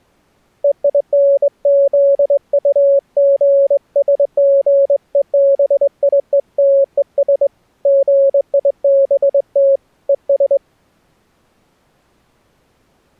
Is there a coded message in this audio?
Yes: Morse code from 0.6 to 10.6 s, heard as a keyed tone, hand-sent with a straight key, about 22 wpm, 550 Hz. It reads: EINZUGSGEBIETES GIBT ES